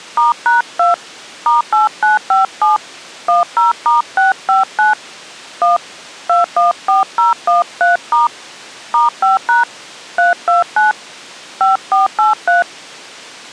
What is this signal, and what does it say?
DTMF, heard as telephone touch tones, dialled by hand, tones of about 150 ms. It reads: *#2 *8957 10*659 1 214013* *5# 329 5483